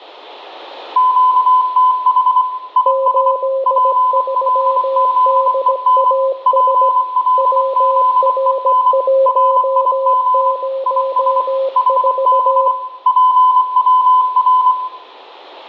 Morse code, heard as two keyed tones, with room echo. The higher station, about 24 wpm, 1010 Hz: QTH IS PLZEN PLZEN RIG IS HB PWR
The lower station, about 17 wpm, 540 Hz: 83DAS WR104